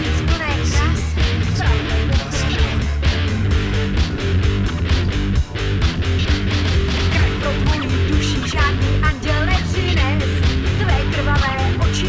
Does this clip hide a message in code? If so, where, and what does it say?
No.